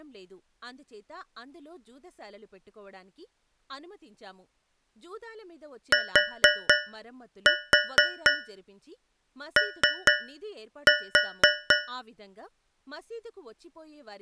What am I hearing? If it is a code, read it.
Tap code, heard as taps on a metal pipe, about 4 knocks a second, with speech in Telugu. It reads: TO